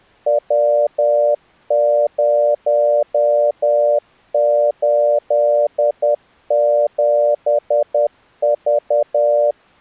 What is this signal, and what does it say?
Morse code, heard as a keyed tone, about 10 wpm, 590 Hz. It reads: W087V